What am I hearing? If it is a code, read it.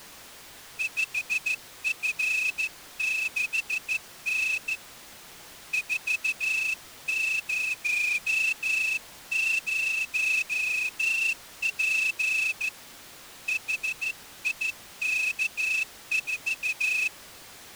Morse code, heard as a whistle, hand-sent with a straight key, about 14 wpm. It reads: 5F6N 400P HIK4